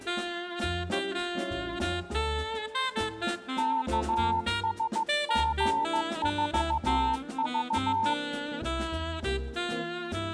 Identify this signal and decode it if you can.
Morse code, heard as a keyed tone, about 15 wpm, 900 Hz. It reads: KSG4V